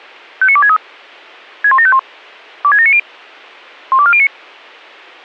Five-tone selective call (ZVEI), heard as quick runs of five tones, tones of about 70 ms. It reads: 59263 61751 26790 12409